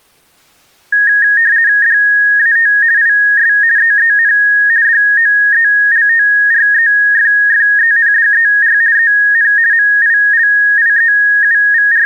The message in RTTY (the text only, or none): DAT IS EEN DOELTREFFENDER EN …